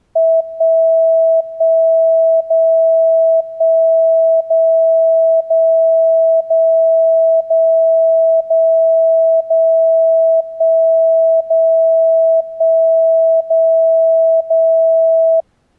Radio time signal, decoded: 1 1 0 1 0 0 0 0 0 0 1 0 1 0 0

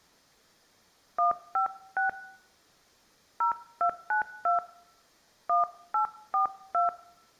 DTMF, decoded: 156 0292 1842

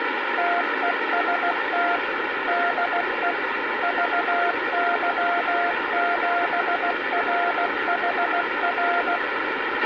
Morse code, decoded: TEST DE VY7RHR

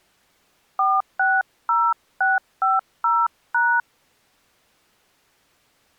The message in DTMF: 460650#

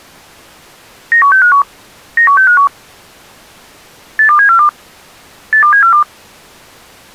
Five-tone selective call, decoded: 91651 91651 82742 82742

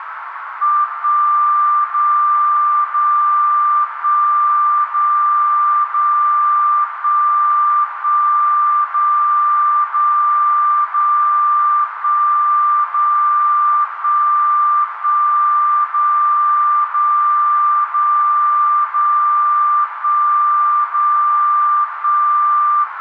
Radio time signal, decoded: 1 0 0 1 0 0 1 1 0 0 0 1 0 1 1 0 0 0 0 1 0 1

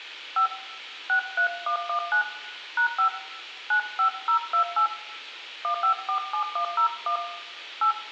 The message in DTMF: 5 63119 #5 95028 1547101 8

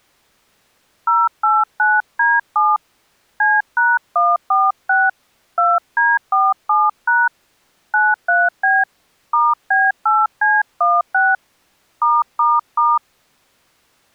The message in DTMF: 089D7 C#146 2D47# 93B *B8C16 ***

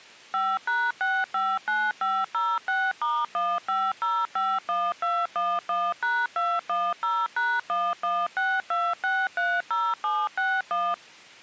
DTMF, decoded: 5#659506*15051211#210#1162630761

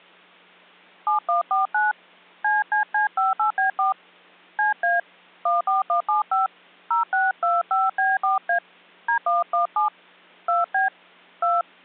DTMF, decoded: 7149 CCC58B4 CA 14175 0625B4A D117 2B 2

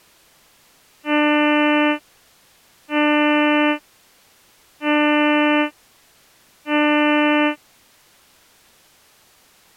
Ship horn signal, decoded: 4 short

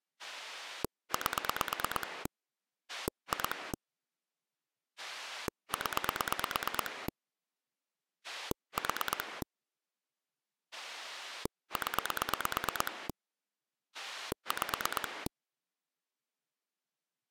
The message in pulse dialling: 8 2 0 4 0 5

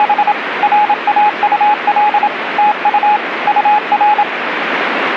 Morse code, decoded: … RAUL TU UR

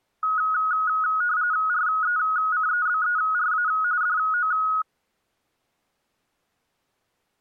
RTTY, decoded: RECEBERA DO

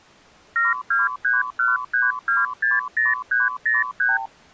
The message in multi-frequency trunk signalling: 72313260303

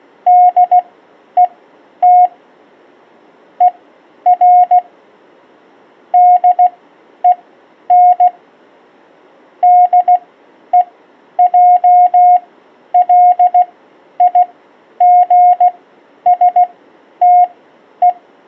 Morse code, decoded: DET ER DEN DEJLIGSTE

